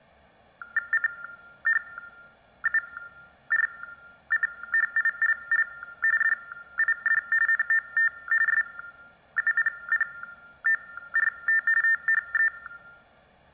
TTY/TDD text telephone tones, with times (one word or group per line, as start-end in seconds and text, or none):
0.9-5.7 CHURCHILL
6.2-7.2 DID
7.5-8.1 NOT
8.5-11.6 SUPPORT
11.8-12.5 THE